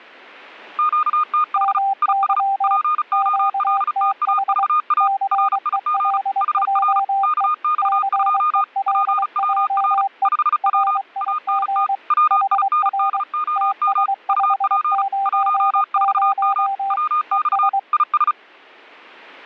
Morse code, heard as two keyed tones. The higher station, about 35 wpm, 1220 Hz: QTH IS POLTAVA RIG HR KX2 PWR 5W ANT WINDOM UP 14M WX IS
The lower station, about 23 wpm, 790 Hz: MY QTH CELJE CELJE RIG HR TS590 ES